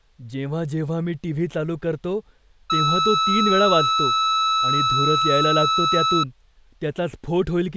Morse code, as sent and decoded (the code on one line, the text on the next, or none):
none